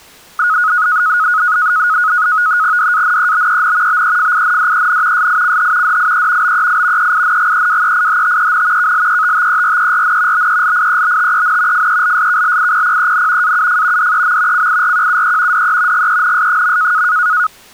NAVTEX (SITOR-B), 100 baud, 170 Hz shift, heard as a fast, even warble, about 1360 Hz centre. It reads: DANEBEN BEFINDEN SICH DIE BEI EINGEWEIHTEN KLETTERERN BELIEBTEN FELSKLIPPEN AUF DEM CIRQUE DE GENS.